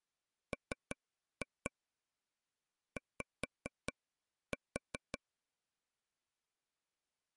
Tap code, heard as taps on a table, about 5 knocks a second. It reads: MY